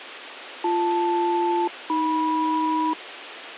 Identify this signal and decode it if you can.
Aircraft SELCAL, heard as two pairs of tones, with radio hiss. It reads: BL-AM